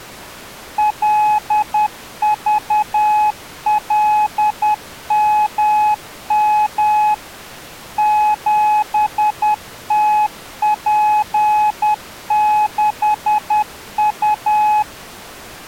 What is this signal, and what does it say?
Morse code, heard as a keyed tone, machine-sent, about 10 wpm, 850 Hz. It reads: LVLMM 7TP6U